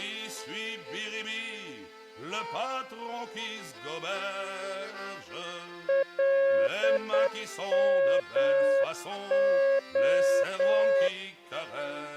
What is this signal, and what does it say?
Morse code (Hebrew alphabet), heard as a keyed tone, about 8 wpm, 550 Hz. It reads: למה